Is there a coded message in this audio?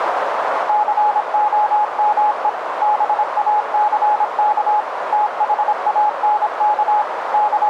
Yes: Morse code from 0.6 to 7.7 s, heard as a keyed tone, machine-sent, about 26 wpm, 840 Hz, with radio static and a narrow filter. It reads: COME BACK THANK …